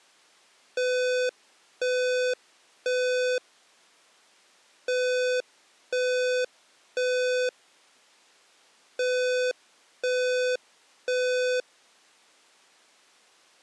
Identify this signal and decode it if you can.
Alarm pattern, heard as an alarm's beeps, played three times, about 500 Hz. Temporal three. Smoke or fire, evacuate.